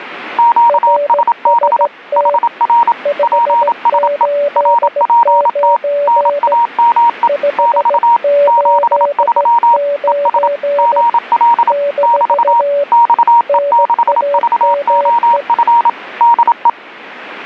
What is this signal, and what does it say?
Morse code, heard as two keyed tones, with radio static. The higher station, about 27 wpm, 940 Hz: QSB HR PSE RPT NAME <BT> 73 ES GL <BT> XE6VOF DE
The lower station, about 16 wpm, 570 Hz: RST 589 589 - NAME